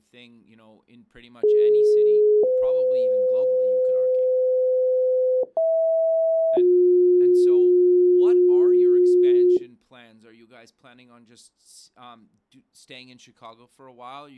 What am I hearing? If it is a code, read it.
Two-tone page, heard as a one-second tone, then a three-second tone, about 420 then 510 Hz, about 650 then 360 Hz, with speech in English.